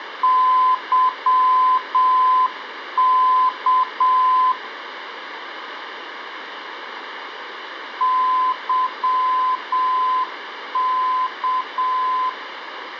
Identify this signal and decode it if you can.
Morse code, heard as a keyed tone, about 7 wpm, 1020 Hz, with radio static. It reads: YK YK